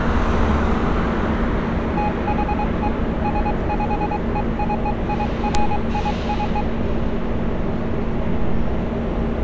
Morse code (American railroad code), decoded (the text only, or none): THE SPECIFIC